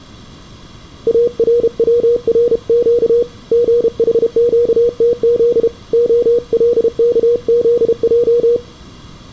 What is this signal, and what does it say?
Morse code (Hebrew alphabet), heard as a keyed tone, hand-sent with a paddle, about 32 wpm, 480 Hz, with room echo. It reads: ארצרק גחקתז הלכזע